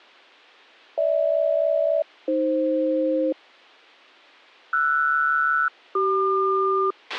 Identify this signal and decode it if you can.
Aircraft SELCAL, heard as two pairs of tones, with a squelch burst at the end. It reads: GH-AF RS-CQ